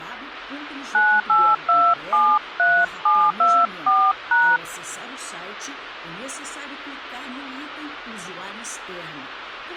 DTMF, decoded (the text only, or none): 98273724#